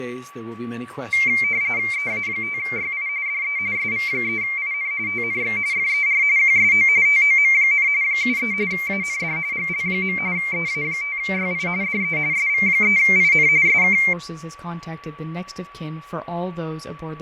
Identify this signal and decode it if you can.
RTTY (45.45 baud, 170 Hz shift), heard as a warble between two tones, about 2200 Hz centre, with fading and a steady whistle near 1140 Hz. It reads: EA5YI DE SV3IN TNX FER QSO TOM, 73 AND GL. EA5YI DE SV3IN SK